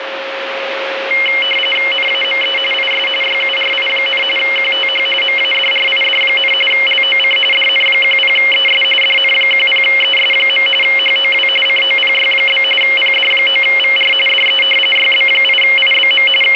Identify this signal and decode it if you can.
RTTY (45.45 baud, 850 Hz shift), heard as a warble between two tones, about 2550 Hz centre, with radio static and a steady whistle near 540 Hz. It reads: NAME IS YURI, QTH MADRID, LOC DN10ES DN10ES. HOW COPY? PD9VR DE YB8IBM …